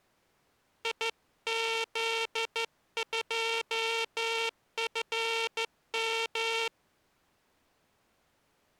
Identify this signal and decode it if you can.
Morse code, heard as a buzzer, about 13 wpm. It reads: IZ2FM